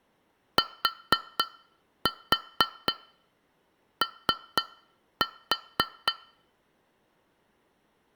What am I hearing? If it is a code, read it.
Tap code, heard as taps on glass, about 4 knocks a second. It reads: TO